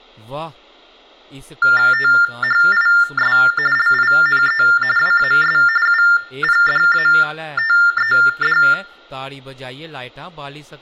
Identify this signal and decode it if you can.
TTY/TDD text telephone tones (45.45 baud Baudot), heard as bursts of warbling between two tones, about 400 Hz shift, 1600 Hz centre, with speech in Dogri. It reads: THIS LINE WAS UPDATED